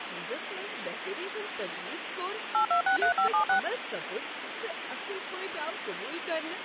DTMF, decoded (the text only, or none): 8263576